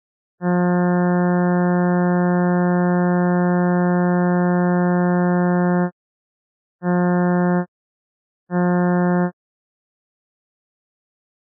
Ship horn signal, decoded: 1 long, 2 short

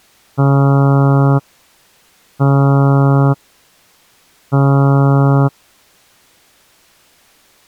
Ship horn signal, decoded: 3 short

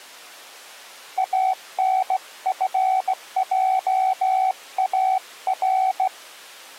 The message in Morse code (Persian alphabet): انفجار

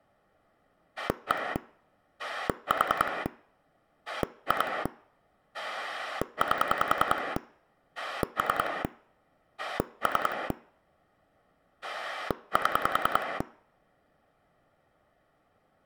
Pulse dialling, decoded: 1 4 2 8 3 3 7

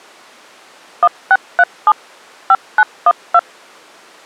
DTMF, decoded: 1637 5912

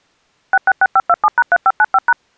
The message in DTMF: 666527#3595#

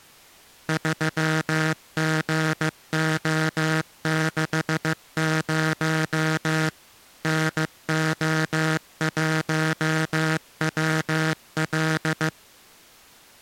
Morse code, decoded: 3GO60 NO1WL

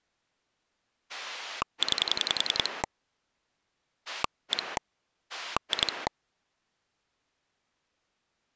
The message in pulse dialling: 9 1 2

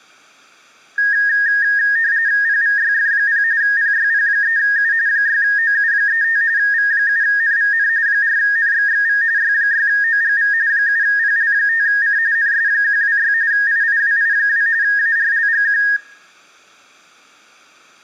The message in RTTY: PVYF0 PYP3U 6OU35 V7NVN 4NXXV Y6OGV 7PL5C NS126 IIWI2 ARLGQ

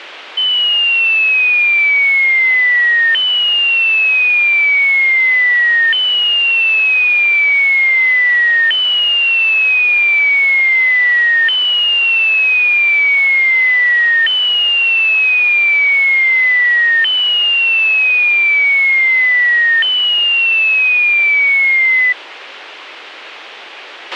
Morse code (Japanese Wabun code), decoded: none

